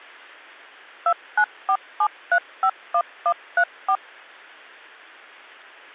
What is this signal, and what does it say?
DTMF, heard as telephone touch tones, dialled by machine, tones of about 70 ms. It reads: 2947351134